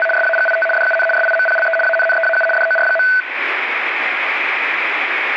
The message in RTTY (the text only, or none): … SAGIT DUN SIMPLE ANNEAU DOR.